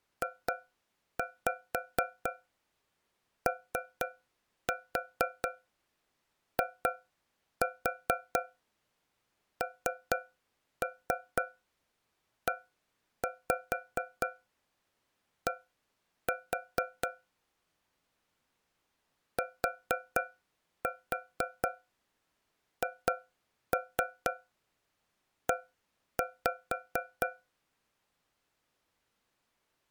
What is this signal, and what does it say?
Tap code, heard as taps on a metal pipe, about 4 knocks a second. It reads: JOINED THE